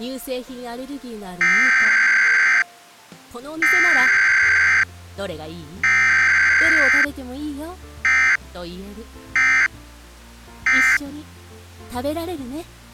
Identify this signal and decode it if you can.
Emergency Alert System (SAME) tones (header bursts, then end-of-message bursts), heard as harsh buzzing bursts, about 520.83 baud.